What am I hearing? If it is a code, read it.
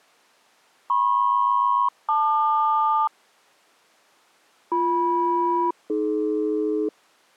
Aircraft SELCAL, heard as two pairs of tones. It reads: MP-LQ BM-AD